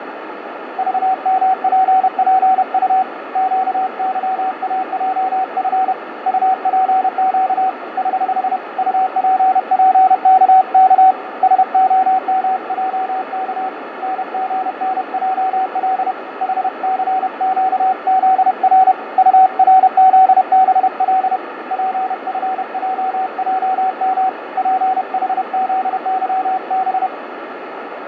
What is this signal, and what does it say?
Morse code, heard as a keyed tone, hand-sent with a paddle, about 31 wpm, 760 Hz, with radio static and fading. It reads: VMPPU QYAJF UPQ <HH> UPPKK SOMJK NGNJL HCQZR URZBL PFJJM PHZYB